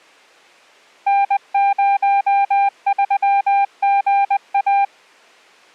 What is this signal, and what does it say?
Morse code, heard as a keyed tone, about 20 wpm, 800 Hz. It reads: N03GA